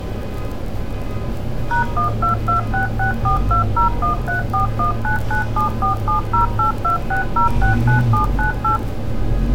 DTMF, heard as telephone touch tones, dialled by machine, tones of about 120 ms, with street noise. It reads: #122664201341997470826069798